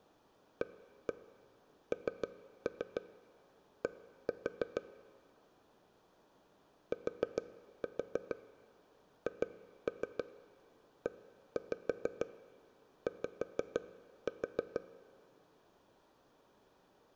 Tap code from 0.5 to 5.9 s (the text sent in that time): AND